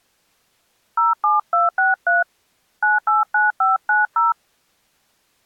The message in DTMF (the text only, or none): 07263 989590